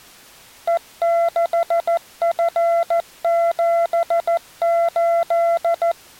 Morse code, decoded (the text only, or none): E6F78